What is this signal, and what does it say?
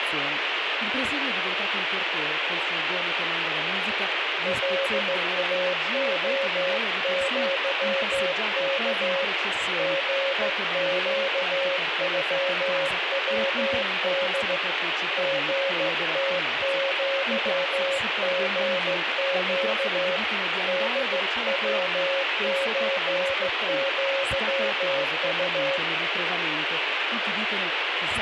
Morse code (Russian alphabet), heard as a keyed tone, hand-sent with a straight key, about 15 wpm, 550 Hz, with radio static. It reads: ЛАОЪК ГЩЮВД ГТЪГЩ ДВЧЪУ